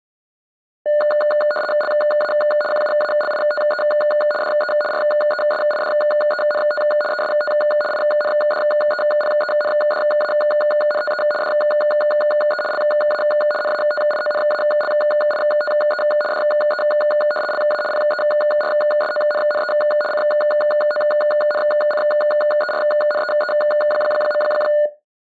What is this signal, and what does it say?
RTTY (75 baud, 850 Hz shift), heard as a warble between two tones, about 1020 Hz centre. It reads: LA QUALITE DE RESIDENT EST INDEPENDANTE DE LA NATIONALITE DE LA PERSONNE CONCERNEE.